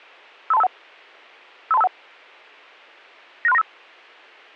Five-tone selective call (EIA), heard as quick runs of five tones, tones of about 30 ms. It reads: 53251 53251 96395